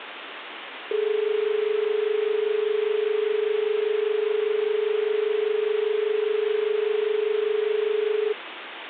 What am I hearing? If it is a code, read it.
Telephone call progress tone (as in Australia), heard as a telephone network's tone, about 430 Hz, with phone line noise. Dial tone.